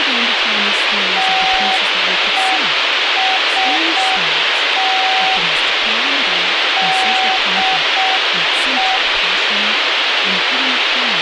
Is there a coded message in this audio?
Yes: Morse code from 1.1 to 9.0 s, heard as a keyed tone, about 6 wpm, 760 Hz, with radio hiss, a squelch burst at the end and speech in English. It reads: TEST DE